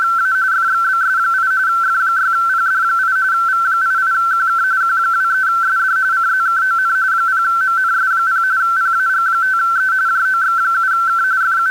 RTTY (45.45 baud, 170 Hz shift), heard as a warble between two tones, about 1440 Hz centre. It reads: … FXBS8 F6PD8 V88QK Q23SD CZKON 0MNS0 PAG5E JOX7K …